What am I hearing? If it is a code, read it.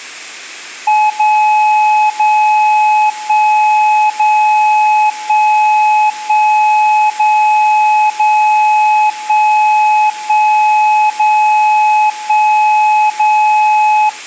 Radio time signal (DCF77), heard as a tone whose level steps once a second, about 850 Hz. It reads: 0 0 1 0 1 1 0 0 1 1 0 1 0